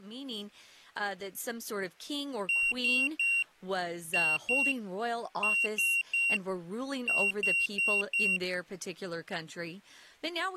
Beep code, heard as a piezo beeper, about 2750 Hz, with speech in English. 3-2-3-4.